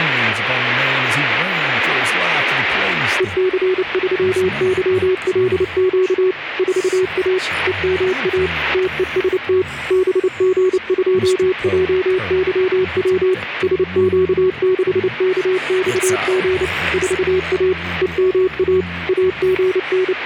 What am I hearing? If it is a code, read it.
Morse code, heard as a keyed tone, machine-sent, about 29 wpm, 370 Hz, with radio static. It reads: EC3YLQ 4A EMA TEST BG2JYW SQ6KXG 4A EMA …